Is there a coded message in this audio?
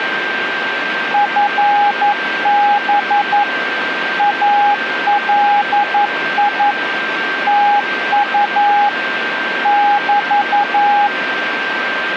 Yes: Morse code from 1.1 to 11.1 s, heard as a keyed tone, machine-sent, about 11 wpm, 820 Hz, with radio static and a steady whistle near 1570 Hz. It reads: FB ALI TU <BT>